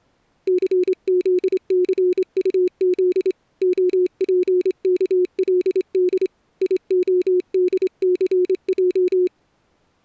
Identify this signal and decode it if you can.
Morse code, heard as a keyed tone, hand-sent with a straight key, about 26 wpm, 360 Hz. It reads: CZCUZ OPKLD IODCJ